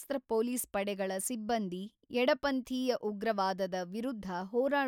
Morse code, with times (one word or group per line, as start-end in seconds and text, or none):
none